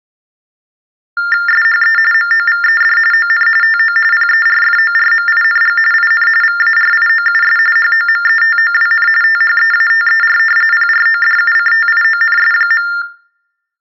TTY/TDD text telephone tones (45.45 baud Baudot), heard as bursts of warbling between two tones, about 400 Hz shift, 1600 Hz centre. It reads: SHE MOVED ON TO PERFORMING IN VARIOUS HOMETOWN THEATER PRODUCTIONS.